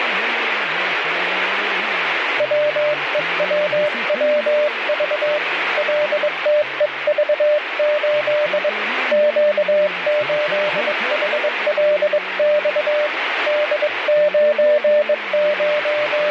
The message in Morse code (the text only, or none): WEWWV LTEV8 Q8HLX …